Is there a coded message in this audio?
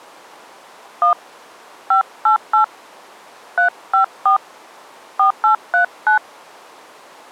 Yes: DTMF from 1.0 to 6.2 s, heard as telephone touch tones, dialled by hand, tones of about 110 ms. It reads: 1 588 354 4839